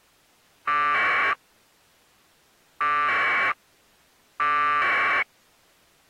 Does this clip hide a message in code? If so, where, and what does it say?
Yes: packet radio (AX.25, as in APRS), 1200 baud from 0.7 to 5.2 s, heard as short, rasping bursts.